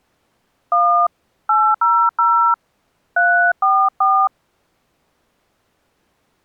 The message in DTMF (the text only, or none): 1 800 344